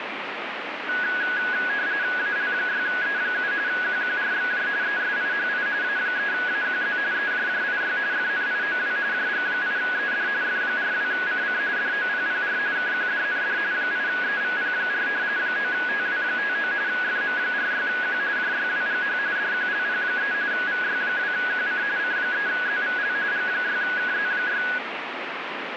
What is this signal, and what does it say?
RTTY (45.45 baud, 170 Hz shift), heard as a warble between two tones, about 1550 Hz centre, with radio static. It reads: AL6E7 QQRXJ ESIHI A3AQZ EJJIY FNIOW JG8ED F42CC DOPPR KQDND 8EVP4 9TW59 FM46Q JYWGH DQLP3 VY2QC C3ZVL G6KZ6